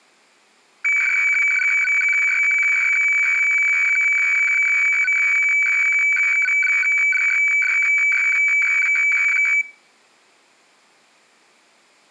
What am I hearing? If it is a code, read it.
Weather fax (radiofax), 120 lines a minute, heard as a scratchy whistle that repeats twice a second.